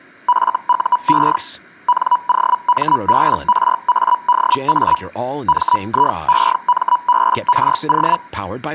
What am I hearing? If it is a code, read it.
Hellschreiber (Feld-Hell, 122.5 baud), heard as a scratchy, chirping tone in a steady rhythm, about 980 Hz, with speech in English. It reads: FUE NOMBRADA MIEMBRO